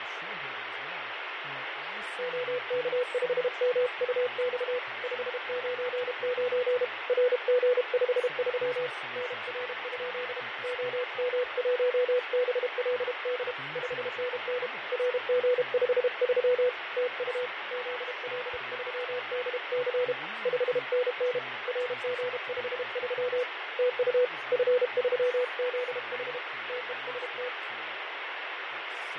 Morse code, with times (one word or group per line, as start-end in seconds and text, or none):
2.2-4.8 OK5MUX
5.0-6.8 599
7.1-8.9 RG53
9.2-10.4 NR?
10.6-13.5 OM1BLD
13.8-14.7 5NN
14.9-16.7 RG53
17.0-17.5 TU
17.7-20.1 ZL3DC
20.5-21.4 5NN
21.7-23.4 RG53
23.8-24.2 TU
24.5-26.4 F3ZH
26.7-27.5 TEST